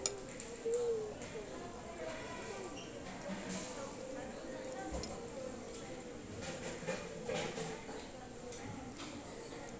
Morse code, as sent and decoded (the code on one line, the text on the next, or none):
none